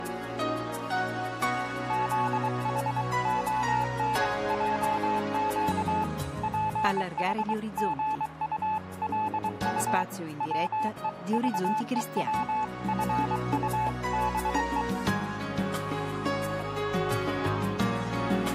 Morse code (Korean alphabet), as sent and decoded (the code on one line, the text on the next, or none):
--.. .... --- -. .--- --.- / .--. .... --. ..- .-.. ..- / .-- . ...- . .-- ..-. ..- -... .
투표해 주시기 바랍니다